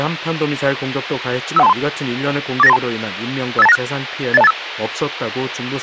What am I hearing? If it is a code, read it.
Five-tone selective call (EIA), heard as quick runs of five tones, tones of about 30 ms, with radio hiss. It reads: 51323 48932 58296 80285